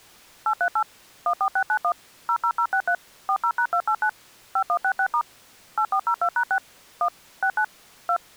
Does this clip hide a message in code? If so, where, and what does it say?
Yes: DTMF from 0.5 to 8.2 s, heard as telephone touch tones, dialled by machine, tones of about 80 ms. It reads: 838 14691 00063 40#289 5166* 8402#6 1 69 2